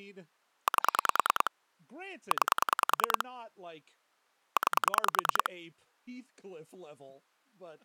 Pulse dialling, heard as clicks on a phone line, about 10 pulses a second, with speech in English. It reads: 8 9 9